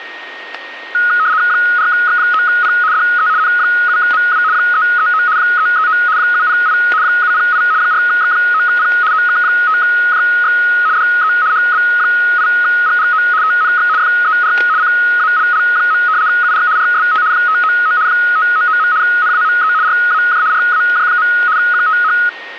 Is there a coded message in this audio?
Yes: RTTY (75 baud, 170 Hz shift) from 0.9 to 22.3 s, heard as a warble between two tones, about 1360 Hz centre, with static crashes and a steady whistle near 1860 Hz. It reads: 4X9P DE N7MW 339 339 708 708 4X9P OK5JX DE HB8GGO TNX FER CALL. UR RST 599 599. NAME RAJ RAJ. QTH